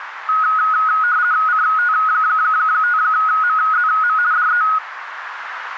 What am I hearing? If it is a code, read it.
RTTY (50 baud, 170 Hz shift), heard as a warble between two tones, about 1360 Hz centre, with radio static and a narrow filter. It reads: CT5MZM DE